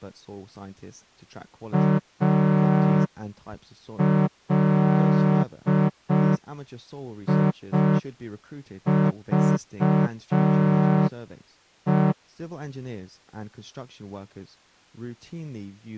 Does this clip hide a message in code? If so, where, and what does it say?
Yes: Morse code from 1.7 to 12.2 s, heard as a horn, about 5 wpm, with speech in English. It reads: ALIVE